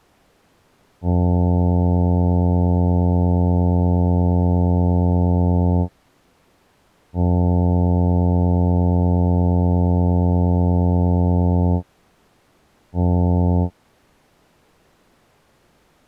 Ship horn signal, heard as a ship's horn, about 90 Hz. 2 long, 1 short. At sea: I intend to overtake on your starboard side.